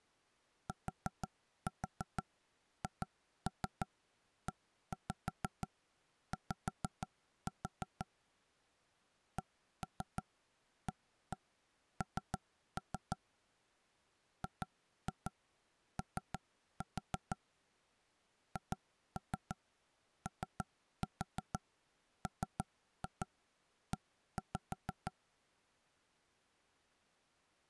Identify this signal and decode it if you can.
Tap code, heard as knocks on wood, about 6 knocks a second. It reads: THEY CAN GO HOME